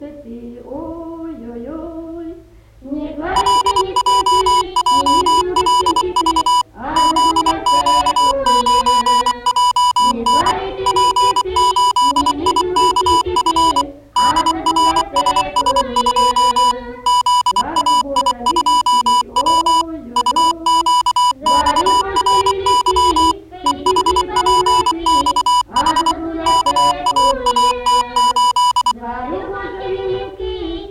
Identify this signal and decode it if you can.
Morse code, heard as electronic beeps, machine-sent, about 24 wpm, 990 Hz. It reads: LJJLV ZQ9JN P8IKF DRSS2 ZAI2W UQXRY EHPXH KAAT8